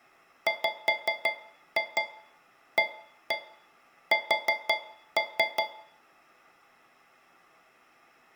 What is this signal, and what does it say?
Tap code, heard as taps on a metal pipe, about 5 knocks a second, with room echo. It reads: WAS